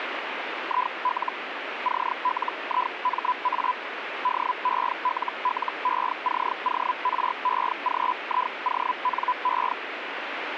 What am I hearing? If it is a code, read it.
Hellschreiber (Feld-Hell, 122.5 baud), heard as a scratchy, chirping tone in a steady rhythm, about 1000 Hz, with radio static. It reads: IL CLIMA DELLECOREGIONE